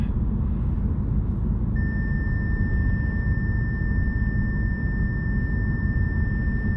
A steady tone, with the noise inside a car. There is no code.